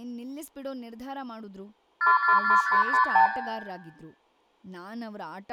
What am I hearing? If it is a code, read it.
Multi-frequency trunk signalling (R2, with the far end's replies), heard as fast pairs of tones, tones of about 110 ms, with room echo and speech in Kannada. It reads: 444556